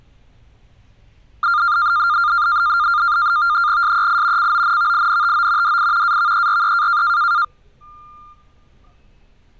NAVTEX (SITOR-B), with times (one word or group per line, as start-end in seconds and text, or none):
3.8-4.5 SEI
4.4-5.8 CONVINTO
5.6-6.2 DI
6.0-7.0 AVERE